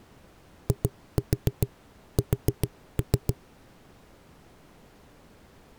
Tap code, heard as knocks on a wall, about 7 knocks a second. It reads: IS